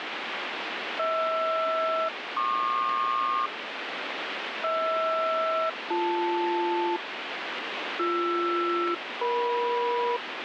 Aircraft SELCAL, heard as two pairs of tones, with radio static. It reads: HR-PQ HR-BL BR-EM